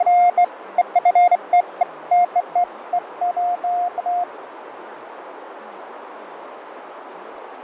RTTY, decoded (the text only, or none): none